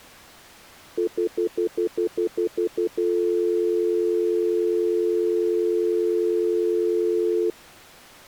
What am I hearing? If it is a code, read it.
Telephone call progress tone (North American plan), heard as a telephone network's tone, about 350, 440 Hz, 0.1 s on and 0.1 s off. Stutter dial tone.